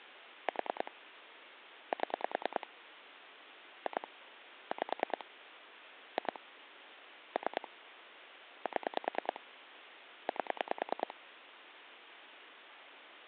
Pulse dialling, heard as clicks on a phone line, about 10 pulses a second. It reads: 4 7 2 5 2 3 7 8